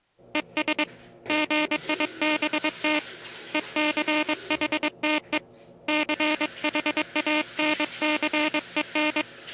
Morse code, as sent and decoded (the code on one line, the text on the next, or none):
. ... / --. .. -... - / . -.-. .... - . / -.-. .... .- -. -.-. . -.
ES GIBT ECHTE CHANCEN